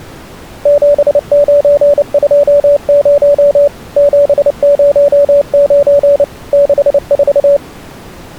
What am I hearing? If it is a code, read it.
Morse code, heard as a keyed tone, machine-sent, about 29 wpm, 570 Hz. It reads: 7920 709 64